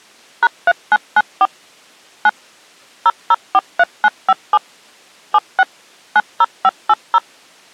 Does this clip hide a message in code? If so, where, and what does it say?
Yes: DTMF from 0.4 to 7.2 s, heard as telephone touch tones, dialled by machine, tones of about 40 ms. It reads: #3994 9 0043957 76 90580